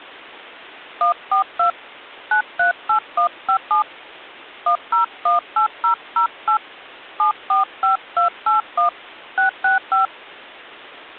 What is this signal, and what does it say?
DTMF, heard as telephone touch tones, dialled by hand, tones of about 110 ms. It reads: 142 938157 1018008 745281 665